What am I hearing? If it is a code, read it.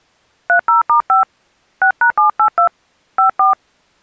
DTMF, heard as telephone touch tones, dialled by hand, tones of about 110 ms. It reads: 30*5 6#782 54